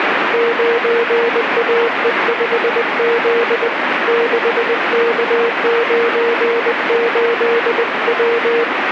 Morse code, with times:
0.3-3.7 9AE5Z
4.1-8.6 6K98W

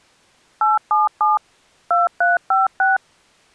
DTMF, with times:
0.6-1.4 877
1.9-3.0 2356

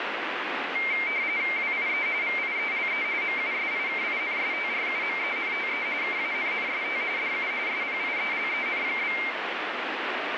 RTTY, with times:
1.6-2.1 WIE
2.2-3.0 VIELE
3.2-5.9 MUSIKINSTRUMENTE
6.0-7.0 KANNST
7.2-7.5 DU
7.7-9.2 SPIELEN?

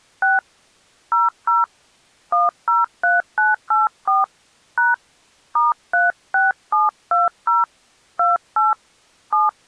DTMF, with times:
0.2-0.4 6
1.1-1.6 00
2.3-4.2 103984
4.8-4.9 #
5.6-7.6 *36720
8.2-8.7 28
9.3-9.5 7

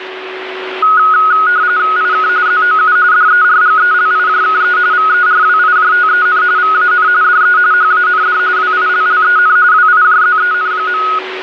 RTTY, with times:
2.0-2.3 IK
2.5-3.0 ZOU
3.1-4.8 DERGELIJKE
4.9-6.4 VERWIJTEN
6.6-7.1 VAN
7.2-7.6 DE
7.7-8.4 HAND
8.6-9.6 WILLEN
9.7-11.0 WIJZEN.

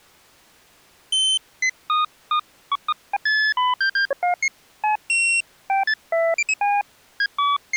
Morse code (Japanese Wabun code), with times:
none

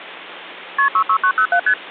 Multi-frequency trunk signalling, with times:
0.8-0.9 KP
0.9-1.6 66907
1.7-1.7 ST

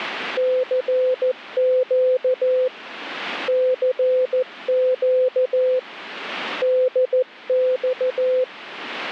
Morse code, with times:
0.4-2.7 CQ
3.5-5.8 CQ
6.6-8.4 DX

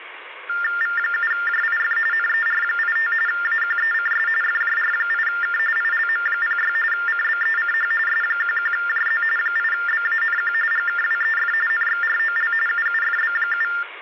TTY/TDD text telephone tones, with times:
0.8-2.0 V7JIF
2.1-3.1 NER85
3.3-4.3 AQECS
4.4-5.6 FJR8K
5.8-6.7 ILM06
6.9-7.9 CBECH
8.1-9.2 S11JZ
9.4-10.5 8BANQ
10.7-11.5 GKWEF
11.7-12.5 NXROL
12.7-13.7 UUFB7

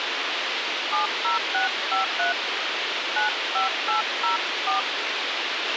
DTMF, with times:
0.9-2.3 70653
3.2-4.8 95804

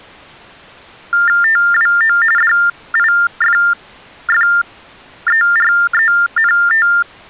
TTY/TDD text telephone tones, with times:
1.4-2.2 TWO
2.4-6.9 DIFFERENT

